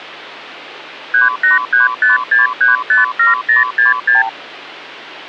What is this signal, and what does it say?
Multi-frequency trunk signalling (R2, with the far end's replies), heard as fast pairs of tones, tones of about 150 ms, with hum. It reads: 38356357066